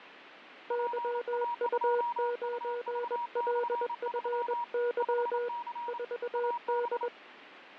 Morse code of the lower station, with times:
0.7-5.5 YU9LFY
5.9-7.1 4D

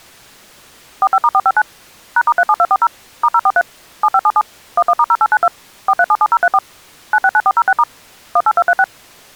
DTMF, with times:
1.0-1.6 45*459
2.2-2.9 #*37240
3.2-3.6 *043
4.0-4.4 7577
4.8-5.5 11*0892
5.9-6.6 4377034
7.1-7.8 969406*
8.4-8.8 18236

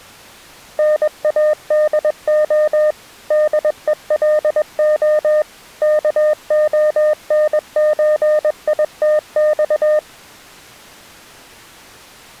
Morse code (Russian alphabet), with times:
0.8-2.9 НАДО
3.3-5.4 ДЕЛО
5.8-10.0 КОНЧИТЬ

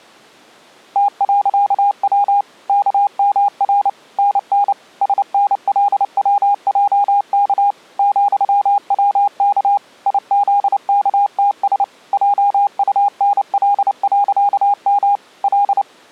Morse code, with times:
1.0-2.4 T.W
2.7-3.9 KMR
4.2-4.7 NN
5.0-7.7 SNLWJK
8.0-9.8 ,WK
10.1-11.8 IZKTS
12.1-15.2 JUNL.M
15.4-15.8 L

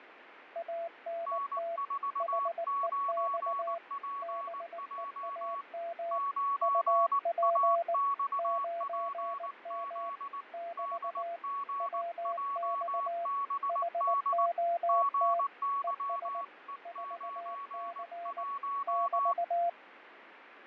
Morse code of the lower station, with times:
0.6-1.8 ANT
2.2-3.8 HEX
4.2-6.2 BEAM
6.6-7.9 UP
8.4-10.1 9M
10.5-11.4 <BT>
11.8-13.3 WX
13.7-15.4 HOT
15.8-16.4 ES
16.9-18.4 4C
18.9-19.7 <BT>

